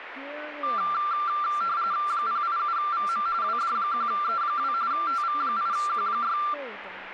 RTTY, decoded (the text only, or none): 087VM WD1E2 TV8Q6